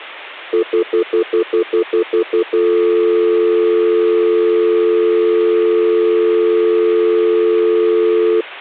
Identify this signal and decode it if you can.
Telephone call progress tone (North American plan), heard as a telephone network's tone, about 350, 440 Hz, 0.1 s on and 0.1 s off. Stutter dial tone.